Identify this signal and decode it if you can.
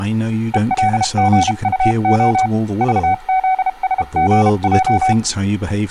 Morse code, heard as a keyed tone, hand-sent with a paddle, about 32 wpm, 750 Hz, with speech in English. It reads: ELGUO VZSGJ